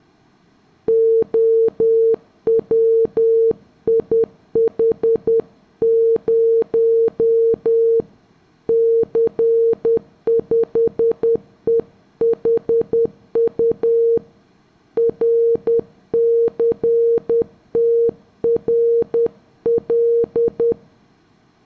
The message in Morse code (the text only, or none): OWIH0 C5EHU RCTRL